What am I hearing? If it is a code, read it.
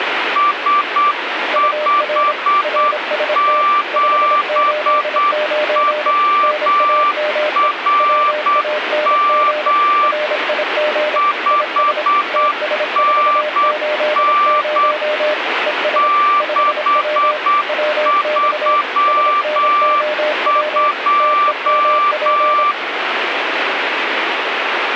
Morse code, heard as two keyed tones, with radio static. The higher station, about 8 wpm, 1170 Hz: S57WRM 5NN 632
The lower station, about 26 wpm, 600 Hz: UR RST 589 NAME WANG RIG IS TS480 ES 5W WX SNOW TEMP